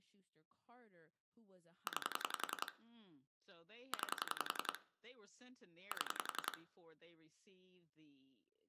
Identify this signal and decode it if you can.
Pulse dialling, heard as clicks on a phone line, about 11 pulses a second, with room echo and speech in English. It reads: 9 9 7